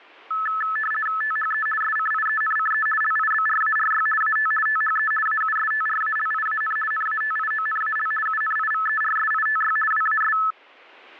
RTTY (50 baud, 450 Hz shift), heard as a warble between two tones, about 1500 Hz centre. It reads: THE SCIENCE LIBRARY AT THE AUSTRALIAN NATIONAL UNIVERSITY WAS